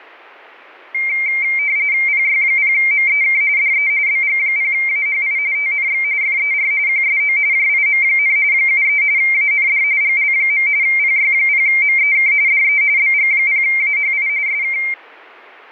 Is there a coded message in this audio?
Yes: RTTY (45.45 baud, 170 Hz shift) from 0.9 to 14.9 s, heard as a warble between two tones, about 2200 Hz centre. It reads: PY0MEK DE BG0AHI TNX FER QSO JIM, 73 AND GL. PY0MEK DE BG0AHI SK